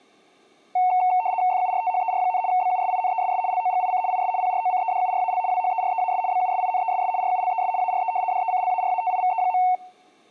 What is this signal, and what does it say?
RTTY (75 baud, 170 Hz shift), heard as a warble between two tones, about 820 Hz centre. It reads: FURTHER, BUSINESS LOGIC IS PROCEDURAL WHEREAS BUSINESS RULES ARE DECLARATIVE.